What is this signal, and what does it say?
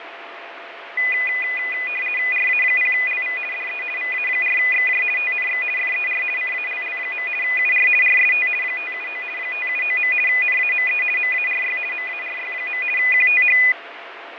RTTY (50 baud, 450 Hz shift), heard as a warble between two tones, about 2250 Hz centre, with radio static and fading. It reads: RA0LV DE VA4XJ TNX FER CALL. UR RST 579 579. NAME MARY MARY. QTH